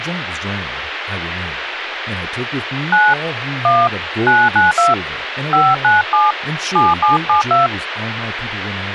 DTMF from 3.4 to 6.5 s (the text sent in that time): 1 992 597